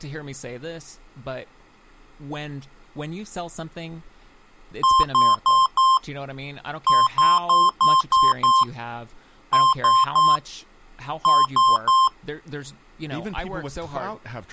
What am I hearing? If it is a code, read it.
Beep code, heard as beeps from a small speaker, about 1050 Hz, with speech in English. 4-6-3-3.